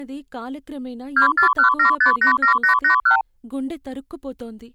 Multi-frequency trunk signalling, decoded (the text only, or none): 2417587881